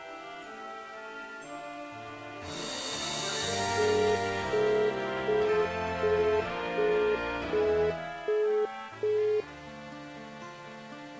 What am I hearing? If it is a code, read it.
Telephone call progress tone (as in the UK, Australia and similar networks), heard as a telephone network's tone, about 420 Hz, 0.375 s on and 0.375 s off. Busy tone.